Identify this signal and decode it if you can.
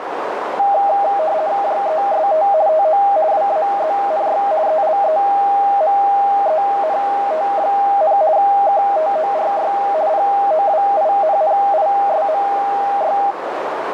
RTTY (50 baud, 170 Hz shift), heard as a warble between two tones, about 720 Hz centre, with radio static and a narrow filter. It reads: JEST TO WAZNY ELEMENT, KTORY POWINNISMY